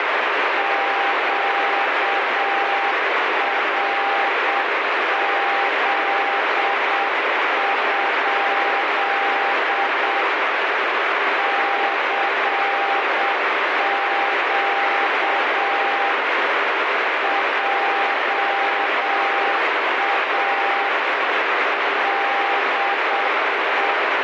Morse code, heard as a keyed tone, hand-sent with a paddle, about 7 wpm, 800 Hz, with heavy radio static. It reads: QRZ? CQ JA DE